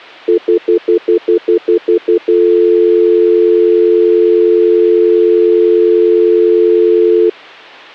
Telephone call progress tone (North American plan), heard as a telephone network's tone, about 350, 440 Hz, 0.1 s on and 0.1 s off. Stutter dial tone.